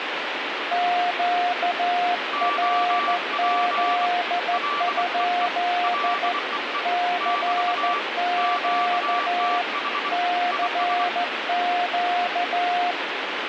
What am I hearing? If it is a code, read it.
Morse code, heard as two keyed tones, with radio static. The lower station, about 14 wpm, 710 Hz: QRZ? CQ CQ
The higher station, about 24 wpm, 1160 Hz: OP LEE LEE <BT> QTH IS